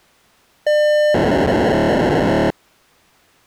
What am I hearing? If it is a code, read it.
POCSAG pager data (1200 baud), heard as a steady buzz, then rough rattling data.